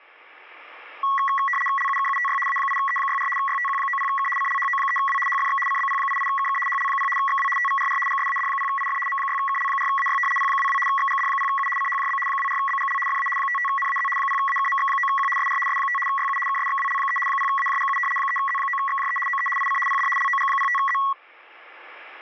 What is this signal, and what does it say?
RTTY (75 baud, 850 Hz shift), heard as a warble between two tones, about 1500 Hz centre. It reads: LUKUTY A8E64 YTQ90K CLHO3W HFX CBP88KK HL0 XW TVRR GSAD0IF M6KL4AY P22 XGD0U CHJB 24BGL FA 55NAZ 0AKMX9Q SR S5 YU KSXWL3 0AJGU 3Z9XJE OE IC PD LOG05Z